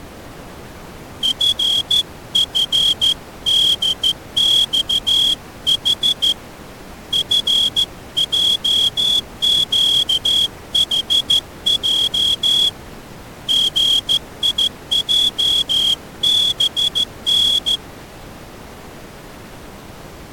Morse code, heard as a whistle, hand-sent with a straight key, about 14 wpm. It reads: FFDXH FJQHJ GIJBN